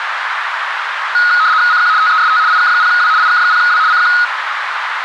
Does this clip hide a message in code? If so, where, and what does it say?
Yes: RTTY (75 baud, 170 Hz shift) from 1.1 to 4.2 s, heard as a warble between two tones, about 1360 Hz centre, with radio static and a narrow filter. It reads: CQ TEST IK0W IK0W CQ